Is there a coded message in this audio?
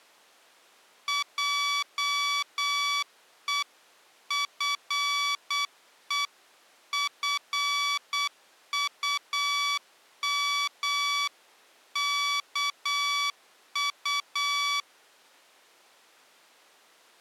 Yes: Morse code (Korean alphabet) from 1.0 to 14.9 s, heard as electronic beeps, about 8 wpm, 1140 Hz. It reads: 하나님이